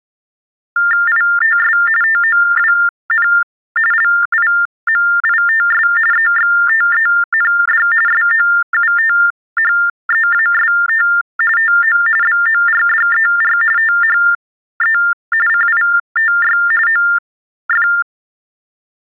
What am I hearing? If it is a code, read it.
TTY/TDD text telephone tones (45.45 baud Baudot), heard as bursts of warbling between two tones, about 400 Hz shift, 1600 Hz centre. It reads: ITS TOWN LIMITS EXTEND SOUTHEAST TO BORDER THE CITY OF